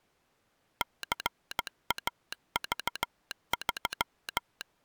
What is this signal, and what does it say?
Morse code, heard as a telegraph sounder, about 15 wpm. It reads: CAV3